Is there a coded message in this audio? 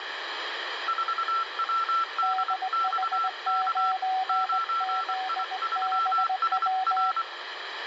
Yes: Morse code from 0.8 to 7.3 s, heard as two keyed tones, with radio static and room echo. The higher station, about 24 wpm, 1340 Hz: 4WDXK 9I3SR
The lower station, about 19 wpm, 750 Hz: DH9ZBW